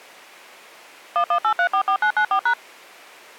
DTMF, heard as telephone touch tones, dialled by machine, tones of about 80 ms. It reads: 118344994#